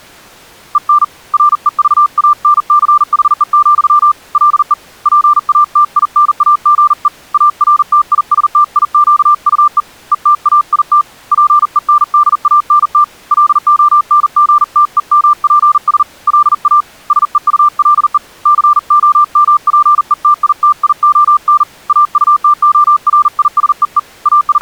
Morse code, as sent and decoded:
. -. / .-. . ...- .- -. -.-. .... . --..-- / .-.. . / .--. .- - .. -. .- --. . / .- .-. - .. ... - .. --.- ..- . / . - .- .. - / .--. . -. -.. .- -. - / .-.. --- -. --. - . -- .--. ... / .-.. .- / ... . ..- .-.. . / -.-. --- -- .--. . - .. - .. --- -. / .- ..- - --- .-. .. ... . . / …
EN REVANCHE, LE PATINAGE ARTISTIQUE ETAIT PENDANT LONGTEMPS LA SEULE COMPETITION AUTORISEE …

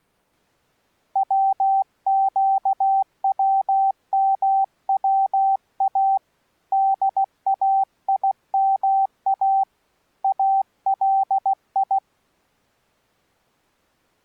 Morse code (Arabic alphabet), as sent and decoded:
.-- --.- .-- -- .-- .- / -.. .- .. -- .- / .- .-.. ..
وقوموا دايما الي

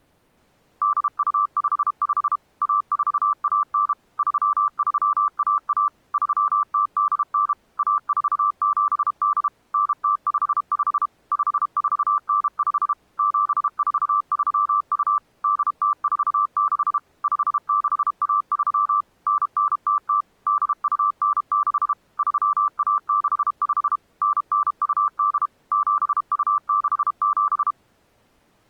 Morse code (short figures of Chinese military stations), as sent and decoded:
-.. ..- ..... ..... / .- ....- .- -. / ...-- ...-- .- .- / ...-- - -.. -. / .- ....- --... -.. / -. - ..... ..... / ..... ....- -. ..... / --... ....- ...-- ..- / -.. - ....- -.... / ..... -.... .- ...-- / -. -. - - / -.. ..- -. -.... / ...-- .- -.... ..... / -. -. ..- -.. / --... ..- -.... --...
8255 1419 3311 3089 1478 9055 5495 7432 8046 5613 9900 8296 3165 9928 7267

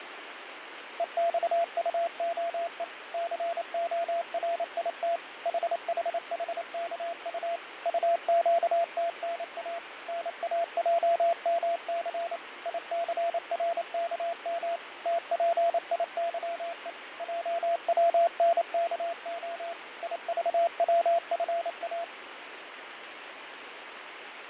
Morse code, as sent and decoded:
. -..- ..- --- . / -.-. --- .-. .. - / .... .... .... -.- ..- / ..- --.- - -. .- / -. .- .--- -- -.-. / .. -.-. .-. -.- -- / - .--. .. -.-- . / .--- .-- -. -.- --- / .. ...- .-- ..-. .-
EXUOE CORIT HHHKU UQTNA NAJMC ICRKM TPIYE JWNKO IVWFA

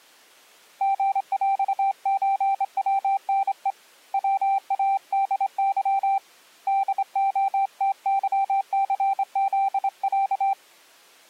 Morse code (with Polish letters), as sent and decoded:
--. .-..- ---. .-- -. . / .-- .- -.. -.-- / -.. --- - -.-- -.-. --.. .-.-
GŁÓWNE WADY DOTYCZĄ

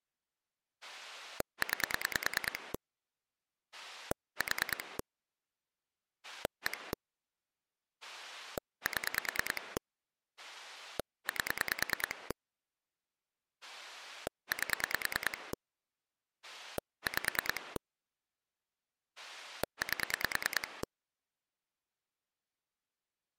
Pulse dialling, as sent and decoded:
9 / 4 / 1 / 7 / 8 / 8 / 5 / 8
9 4 1 7 8 8 5 8

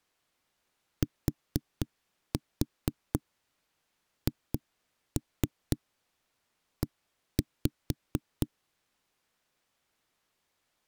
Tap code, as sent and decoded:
4-4 2-3 1-5
THE

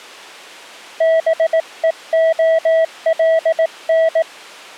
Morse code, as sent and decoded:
-... . --- .-.. -.
BEOLN

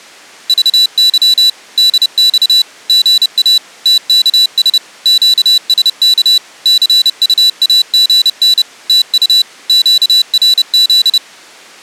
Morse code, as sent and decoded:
...- -.-- / -.. -..- / --. .- / - -.- ... / --.- ... -.- / -.-. ..- .- --. -. / - ..- / --.- .-. --..
VY DX GA TKS QSK CUAGN TU QRZ

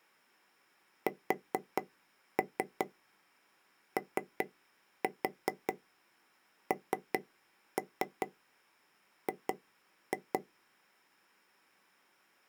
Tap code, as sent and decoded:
4-3 3-4 3-3 2-2
SONG

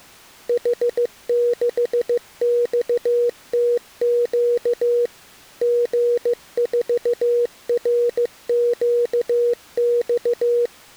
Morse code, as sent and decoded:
.... -.... -..- - --.- / --. ....- .-. --.- -..-
H6XTQ G4RQX

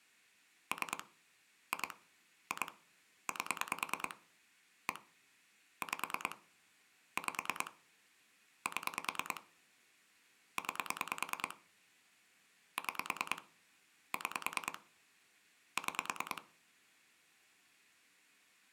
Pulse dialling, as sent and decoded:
3 / 2 / 2 / 8 / 1 / 5 / 5 / 7 / 9 / 6 / 6 / 6
3 2 2 8 1 5 5 7 9 6 6 6

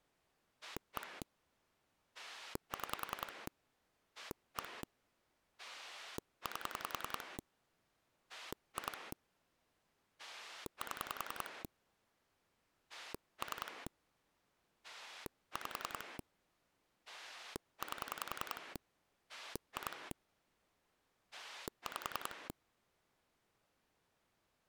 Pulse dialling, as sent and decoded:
1 / 6 / 1 / 8 / 2 / 7 / 3 / 5 / 8 / 2 / 5
1 6 1 8 2 7 3 5 8 2 5

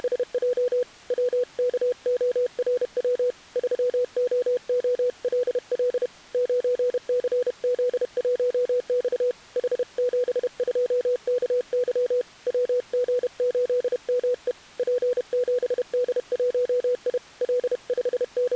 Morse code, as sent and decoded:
… / .-- -.- --- .-. .-- / ...-- --- --- .-.. .-.. / ----. -.-. --.. .---- -..- / .... --... ..--- -.- -.-- / .-- --. ---.. -- . / .--. --... -.. .---- .. / …
… WKORW 3OOLL 9CZ1X H72KY WG8ME P7D1I …

